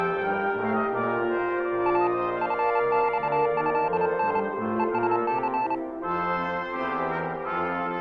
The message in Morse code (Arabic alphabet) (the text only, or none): ا فصهن ءسث